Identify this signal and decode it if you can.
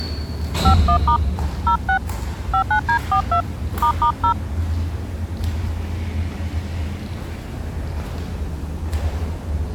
DTMF, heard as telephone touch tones, dialled by hand, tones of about 90 ms, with the noise inside a lift. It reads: 51* 06 59D42 **0